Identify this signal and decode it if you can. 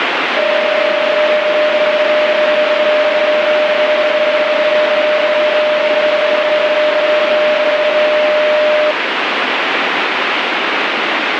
PSK31 (31.25 baud), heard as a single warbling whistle, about 610 Hz, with radio static.